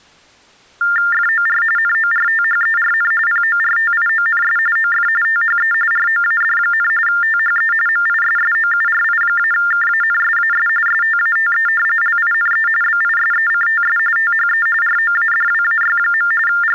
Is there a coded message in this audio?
Yes: TTY/TDD text telephone tones (45.45 baud Baudot) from 0.8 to 16.8 s, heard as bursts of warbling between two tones, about 400 Hz shift, 1600 Hz centre. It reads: FOR NORTHERN PORTIONS OF THE ROAD, THE MISSOURI-KANSAS STATE LINE BISECTS THE ROADWAY. …